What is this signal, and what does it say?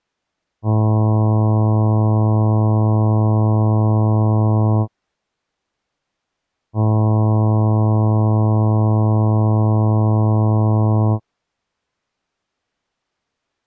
Ship horn signal, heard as a ship's horn, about 110 Hz. 2 long. At sea: a vessel under power that has stopped in fog.